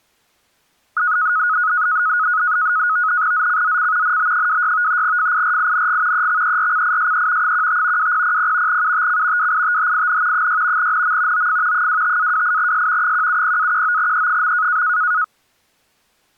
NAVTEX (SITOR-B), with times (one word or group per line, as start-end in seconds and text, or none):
3.3-4.2 ZCZC
4.0-5.0 NB26
5.0-6.3 FIRING
6.1-7.5 EXERCISE
7.4-8.1 15
8.0-8.8 2000
8.7-9.5 UTC
9.4-10.5 WITHIN
10.3-10.9 6
10.8-11.5 NM
11.3-11.9 OF
11.7-13.1 25-28S
13.0-14.8 170-19E.